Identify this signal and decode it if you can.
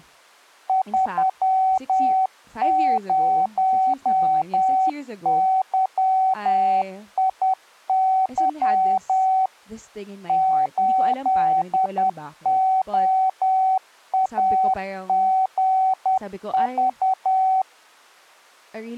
Morse code, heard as a keyed tone, machine-sent, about 10 wpm, 760 Hz, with speech in English. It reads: 30YIY 8OAGV